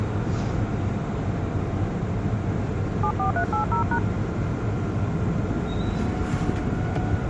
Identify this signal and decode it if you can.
DTMF, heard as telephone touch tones, dialled by hand, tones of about 100 ms, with the noise inside a subway train. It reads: 74380#